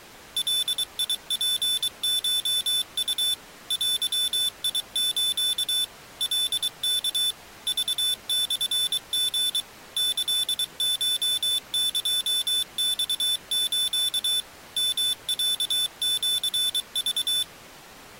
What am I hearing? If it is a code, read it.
Morse code (Japanese Wabun code), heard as a high beeper, machine-sent, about 23 wpm, 3500 Hz. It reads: ガツコウ デス カワ クモリ キコエマス ヨロシク